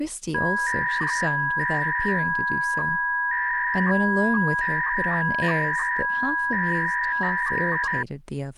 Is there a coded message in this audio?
Yes: 300-baud modem data (V.21 tones) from 0.3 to 8.0 s, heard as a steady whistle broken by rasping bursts, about 300 baud, 200 Hz shift, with speech in English.